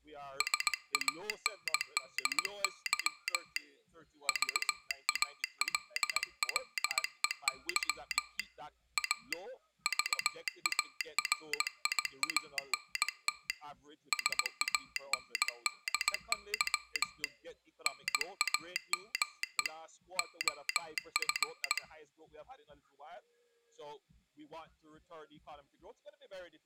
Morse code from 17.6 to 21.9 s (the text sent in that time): NAME OF